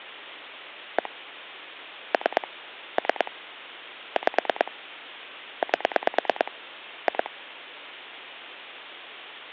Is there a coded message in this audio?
Yes: pulse dialling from 1.0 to 7.3 s, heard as clicks on a phone line, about 9 pulses a second, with hum. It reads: 1 3 3 5 8 2